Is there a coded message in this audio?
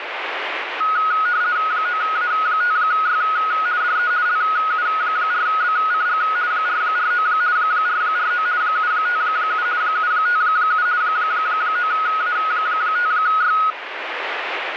Yes: RTTY (50 baud, 170 Hz shift) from 0.8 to 13.7 s, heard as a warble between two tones, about 1360 Hz centre, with radio static. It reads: 9A5Y DE LU4BCG 449 449 757 757 9A5Y